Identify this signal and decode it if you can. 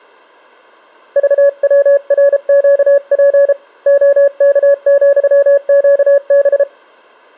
Morse code, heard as a keyed tone, hand-sent with a paddle, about 33 wpm, 560 Hz. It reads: VWRQP OK,QB